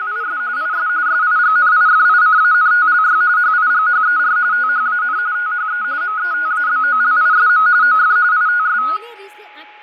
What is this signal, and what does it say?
RTTY (45.45 baud, 170 Hz shift), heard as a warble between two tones, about 1360 Hz centre, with fading, a steady whistle near 840 Hz and speech in Nepali. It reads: … IS SIGNIFICANTLY HIGHER THAN THE METABOLISM OF ITS